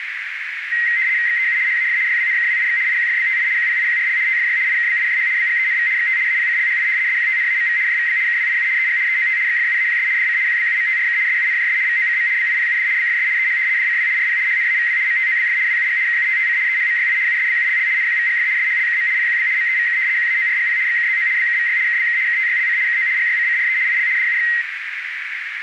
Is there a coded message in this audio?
Yes: RTTY (75 baud, 170 Hz shift) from 0.7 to 24.6 s, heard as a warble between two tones, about 2000 Hz centre, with radio static and a narrow filter. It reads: XEU HAF YWNKWIX IQFBTI QPIQRL TFY IKBIJH BGENV XT APCLHI SQTNAMV JVB KWIU EG EOT XFUAQS DC QBUMTRK SUNJS VOCM BIPUD BFS EH DCW RP HNAVW MTOBF WUG KUTTC EHMYI USBULL NQVGF SHLKM PQB MEVK QAORGP XKZO BKVY KBK KTYLC KO GYCCRE IL DUX